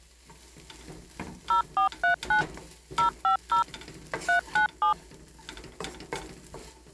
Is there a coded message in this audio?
Yes: DTMF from 1.5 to 4.9 s, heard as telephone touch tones, dialled by machine, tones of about 110 ms, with kitchen noise. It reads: 0439 050 397